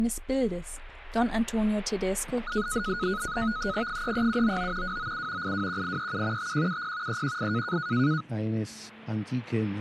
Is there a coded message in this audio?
Yes: NAVTEX (SITOR-B), 100 baud, 170 Hz shift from 2.5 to 8.2 s, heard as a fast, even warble, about 1360 Hz centre. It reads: 33799 297 821837 5170 318